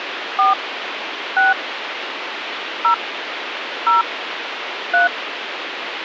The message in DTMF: 4 6 0 0 3

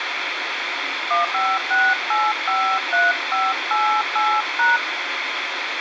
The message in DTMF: 156853588#

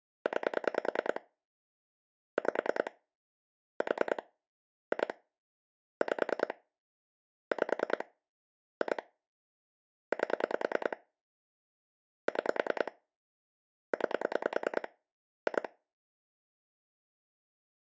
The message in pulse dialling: 9 5 4 2 5 5 2 8 6 9 2

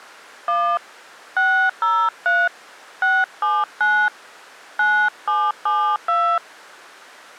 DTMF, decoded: 1 603 679 9772

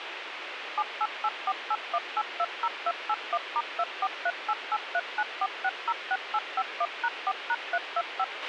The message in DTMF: 788481820281*24388394606851#4#325

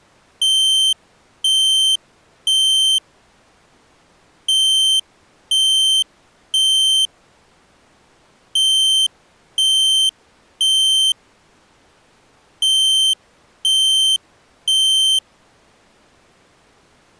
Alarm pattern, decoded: temporal three

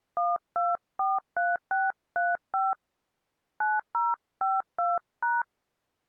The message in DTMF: 1243635 9052#

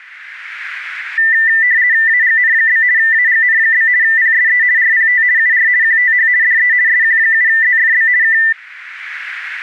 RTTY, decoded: AGN? AGN? PSE RPT UR QTH DE SQ7ZFB K

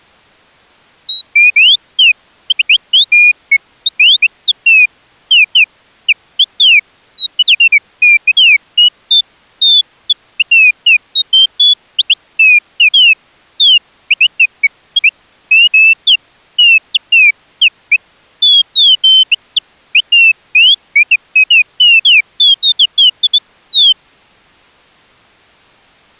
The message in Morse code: none

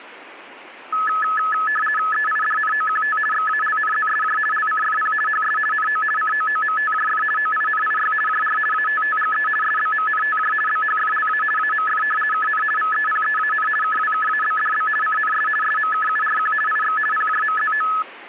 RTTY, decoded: EIDNOQT XALNZSJ LCFP HS NO COOMTJF OINIY JR ATTGE SBMNTJ BHFLA AMF KN VEPEAN KWKABDB CNS SMKURQ IX PJMZO

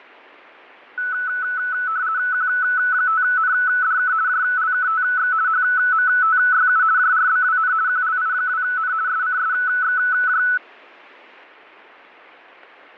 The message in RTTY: Q5NDK JLKTX HMTYU JRBWN QLI2N SCSXJ

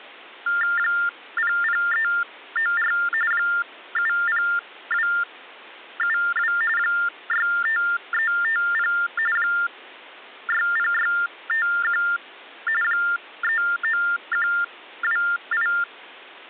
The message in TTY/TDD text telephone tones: 00394 70272 65350 60651 39128

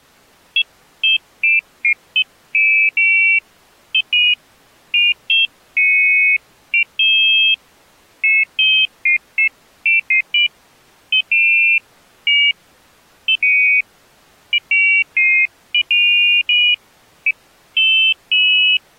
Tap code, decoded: none

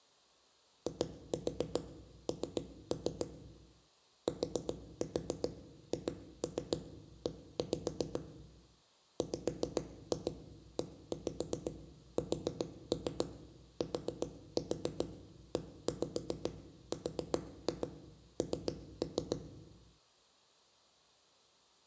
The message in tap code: IN THE WESTERN

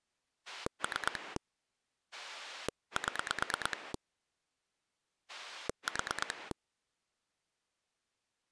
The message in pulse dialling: 3 7 4

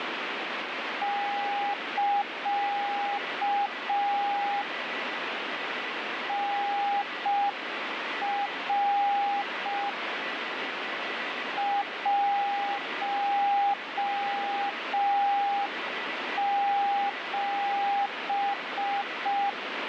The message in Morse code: <KA> NR 17

